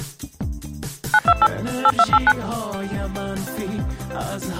DTMF, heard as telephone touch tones, dialled by machine, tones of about 50 ms. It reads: 928 8289